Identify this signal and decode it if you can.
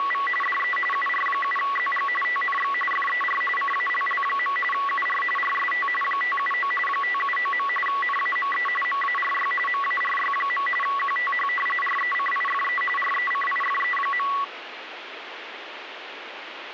RTTY (45.45 baud, 850 Hz shift), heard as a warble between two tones, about 1550 Hz centre, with radio static. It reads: … DE UR7ZG TNX FER CALL. UR RST 579 579. NAME MARY MARY. QTH RECIFE RECIFE.